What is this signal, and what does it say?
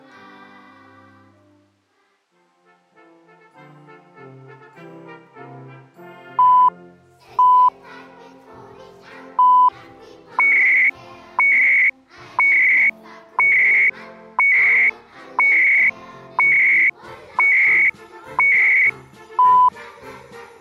Radio time signal (CHU, Canada), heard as beeps and data bursts, one a second.